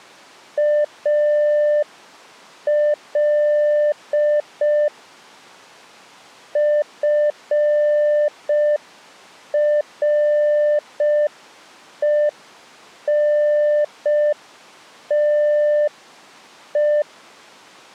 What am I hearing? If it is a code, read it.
Morse code, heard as a keyed tone, hand-sent with a paddle, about 5 wpm, 600 Hz. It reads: AL FRENTE